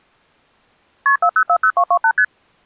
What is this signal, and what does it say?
Multi-frequency trunk signalling (R1, as on North American trunks), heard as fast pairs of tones, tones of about 70 ms. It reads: KP 4040228 ST